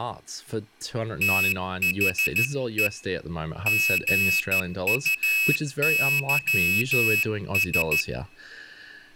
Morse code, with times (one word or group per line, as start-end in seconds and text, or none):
1.2-2.9 THE
3.7-8.0 GUYS